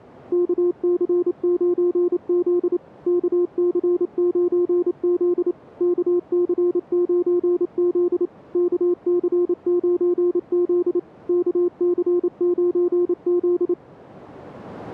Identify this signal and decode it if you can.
Morse code, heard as a keyed tone, machine-sent, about 28 wpm, 350 Hz. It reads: KC9Z KC9Z KC9Z KC9Z KC9Z